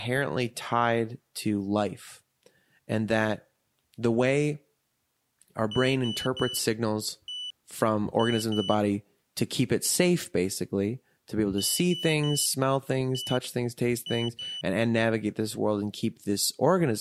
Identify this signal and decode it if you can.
Beep code, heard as a piezo beeper, played twice, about 3000 Hz, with speech in English. 3-1-2. In Phoenix BIOS tables: DMA register failure.